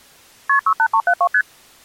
Multi-frequency trunk signalling (R1, as on North American trunks), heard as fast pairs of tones, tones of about 70 ms. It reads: KP 68372 ST